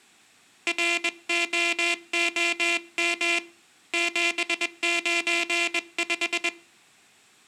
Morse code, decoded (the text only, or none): ROOM 795